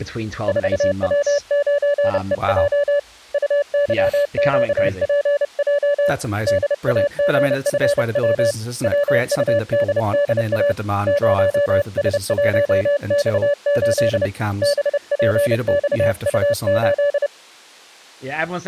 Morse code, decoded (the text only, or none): 4W9EJ UYQPJ DAGFW WUDDA 0S1X8 BPXU8